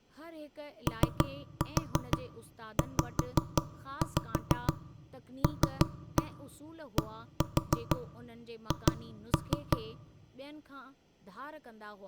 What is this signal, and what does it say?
Tap code, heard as knocks on wood, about 6 knocks a second, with speech in Sindhi. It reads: OZLDH